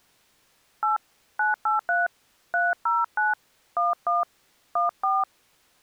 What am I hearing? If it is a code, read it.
DTMF, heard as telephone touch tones, dialled by hand, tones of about 160 ms. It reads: 8 983 309 11 14